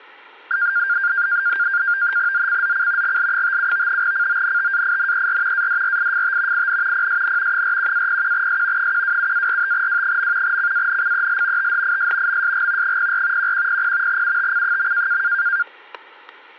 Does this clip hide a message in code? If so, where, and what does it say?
Yes: NAVTEX (SITOR-B), 100 baud, 170 Hz shift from 0.5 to 15.6 s, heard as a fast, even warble, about 1500 Hz centre, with static crashes. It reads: ZCZC GL57 CONTAINER ADRIFT IN PSN 41-01S 127-45W. CANCEL THIS MSG 04 1100 UTC.